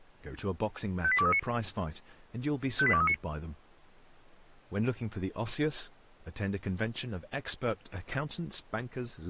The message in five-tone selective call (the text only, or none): 58239 58239